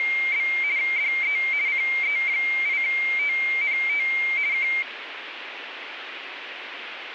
RTTY (50 baud, 170 Hz shift), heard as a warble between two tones, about 2200 Hz centre, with radio static. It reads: … DE CE8TNT K